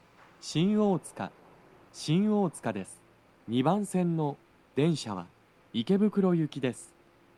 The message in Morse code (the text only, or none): none